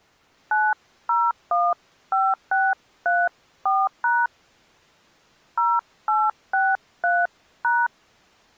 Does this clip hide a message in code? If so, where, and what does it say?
Yes: DTMF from 0.5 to 7.9 s, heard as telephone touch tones, dialled by hand, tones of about 220 ms. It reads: 9015634# 0863#